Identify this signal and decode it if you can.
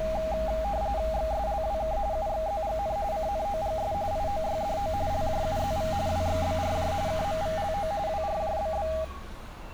RTTY (45.45 baud, 170 Hz shift), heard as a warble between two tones, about 720 Hz centre, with radio static and street noise. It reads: XSLWK UXZGN CNOGS IOYDO LJUZV WXBRJ KMVLO WRJBB